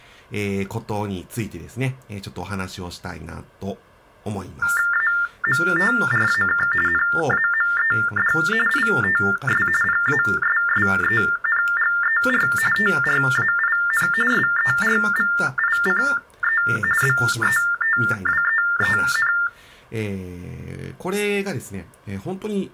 TTY/TDD text telephone tones (45.45 baud Baudot), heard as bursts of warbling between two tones, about 400 Hz shift, 1600 Hz centre. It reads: AMTRAK NAMED ITS PASSENGER TRAIN SERVICE BETWEEN